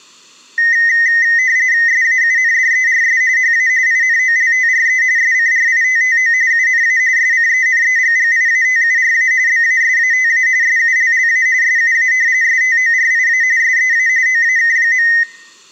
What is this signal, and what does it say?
RTTY (45.45 baud, 170 Hz shift), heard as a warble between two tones, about 1950 Hz centre. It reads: SAUNDERS HA INOLTRE SCRITTO UNA SCENEGGIATURA BASATA SULLA SUA STORIA SEA OAK.